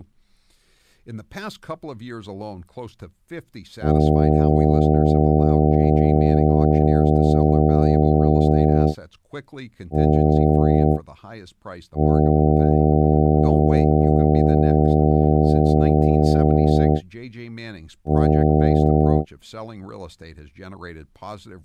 Ship horn signal, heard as a ship's horn, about 80 Hz, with speech in English. 1 long, 1 short, 1 long, 1 short. At sea: I agree to be overtaken.